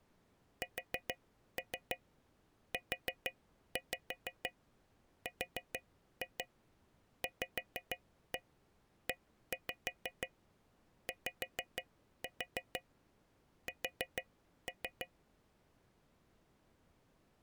Tap code, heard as taps on a metal pipe, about 6 knocks a second. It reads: SURVEYS